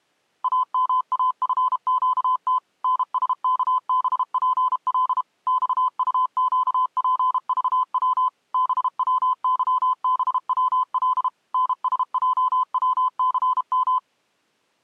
Morse code, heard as a keyed tone, machine-sent, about 32 wpm, 1020 Hz. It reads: AMAFQT NSKBPL XUQPVW BWYBWL NSJWCM